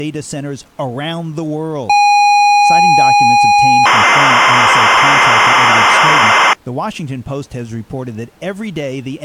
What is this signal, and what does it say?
ZX Spectrum tape loading, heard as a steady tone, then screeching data, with speech in English.